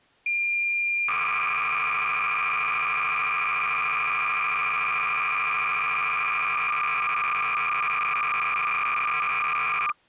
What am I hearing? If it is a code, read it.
Cassette data (Kansas City type), 300 baud, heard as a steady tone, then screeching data.